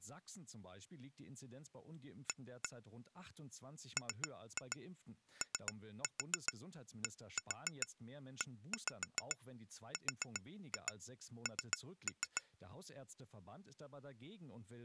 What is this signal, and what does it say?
Tap code, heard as taps on glass, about 7 knocks a second, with speech in German. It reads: A MODERN